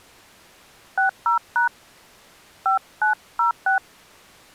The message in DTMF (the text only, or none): 60# 5906